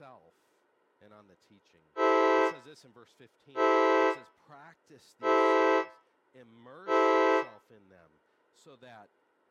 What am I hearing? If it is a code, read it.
Train horn signal, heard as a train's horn, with room echo and speech in English. 4 short. On North American railways: a request for a signal to be given or repeated.